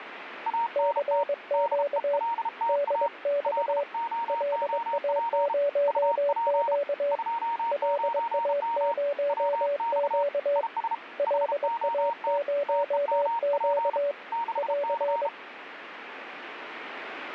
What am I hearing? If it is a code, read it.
Morse code, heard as two keyed tones, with radio static. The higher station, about 33 wpm, 930 Hz: ANT DELTA LOOP UP 29M WX IS HOT TEMP 6C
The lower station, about 22 wpm, 570 Hz: CQ DX LA0Q LA0Q LA0Q <AR>